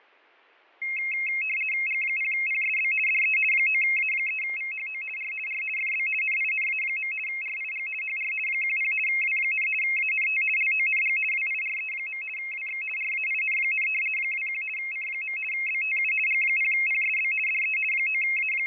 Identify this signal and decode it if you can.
RTTY (50 baud, 450 Hz shift), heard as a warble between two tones, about 2350 Hz centre, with fading and static crashes. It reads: G0PSB DE 9A3VHO R R FB NINA. RIG HR 10 W, ANT LONG WIRE. WX RAIN, 21 C. BTU G0PSB DE …